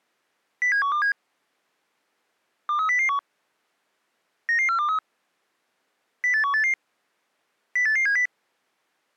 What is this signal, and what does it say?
Five-tone selective call (CCIR), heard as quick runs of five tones, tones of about 100 ms. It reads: 07127 23001 99423 08188 08870